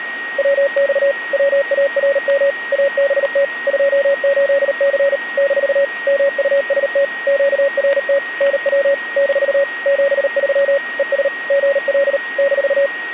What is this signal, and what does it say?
Morse code, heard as a keyed tone, machine-sent, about 38 wpm, 560 Hz, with a steady whistle near 1880 Hz. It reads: WX WARM ABT 28C - MUST QRT NW - 73 ES GL -